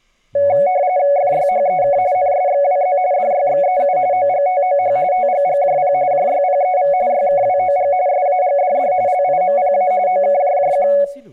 RTTY (45.45 baud, 170 Hz shift), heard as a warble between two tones, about 650 Hz centre, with room echo and speech in Assamese. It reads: FYHEK NSXWZ DYXEU OGTOH TGGJP JYPEV YKWOG SAGDD LIMPA OKJJQ